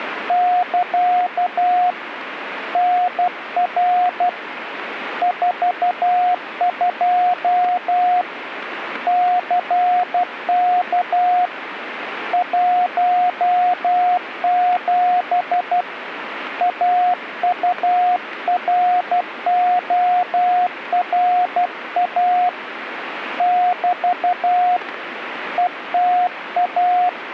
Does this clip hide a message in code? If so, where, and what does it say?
Yes: Morse code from 0.2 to 27.2 s, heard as a keyed tone, hand-sent with a paddle, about 12 wpm, 720 Hz, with radio static. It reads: <KA> NR 42 CK 17 AURORA <BT> ETA